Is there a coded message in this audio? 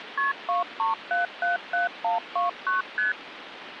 Yes: multi-frequency trunk signalling (R1, as on North American trunks) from 0.2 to 3.1 s, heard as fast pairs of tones, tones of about 140 ms, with phone line noise. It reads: KP 23777129 ST